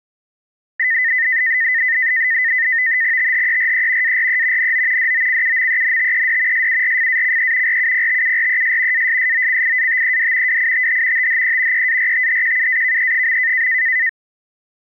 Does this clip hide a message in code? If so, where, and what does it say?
Yes: NAVTEX (SITOR-B), 100 baud, 170 Hz shift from 0.8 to 14.1 s, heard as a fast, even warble, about 1900 Hz centre. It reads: THERE ARE NO DOCUMENTED SURFACE RUPTURES ASSOCIATED WITH THE EARTHQUAKE.